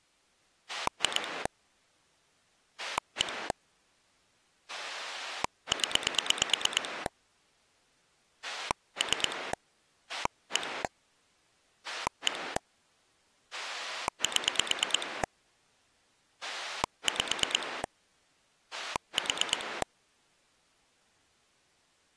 Pulse dialling, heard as a rotary dial, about 9 pulses a second. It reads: 2 1 0 3 1 1 7 5 4